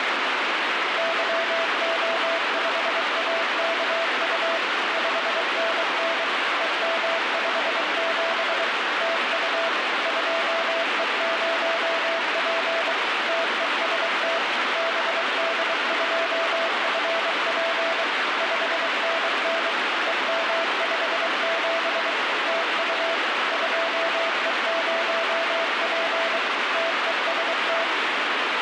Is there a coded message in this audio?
Yes: Morse code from 0.9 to 27.9 s, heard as a keyed tone, machine-sent, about 23 wpm, 660 Hz, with heavy radio static. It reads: YO5AKU 5NN EM57 TU 2E0P TEST BD2FP 5NN EM57 TU 2E0P TEST